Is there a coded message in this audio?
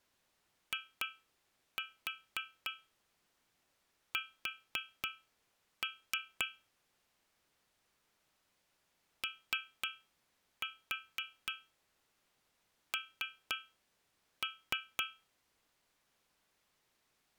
Yes: tap code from 0.7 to 15.3 s, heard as taps on a metal pipe, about 3 knocks a second. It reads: IS ON